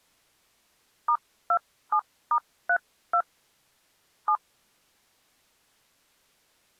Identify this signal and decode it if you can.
DTMF, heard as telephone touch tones, dialled by hand, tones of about 70 ms. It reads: *27*32 7